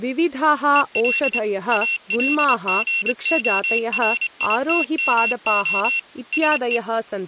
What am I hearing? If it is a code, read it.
Morse code, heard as a high beeper, machine-sent, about 25 wpm, 2700 Hz, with speech in Sanskrit. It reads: EL ALGORITMO SE